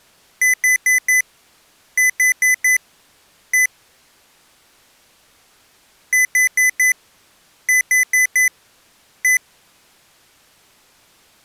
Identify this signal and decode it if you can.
Beep code, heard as beeps from a small speaker, played twice, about 2000 Hz. 4-4-1. In Phoenix BIOS tables: serial port failure.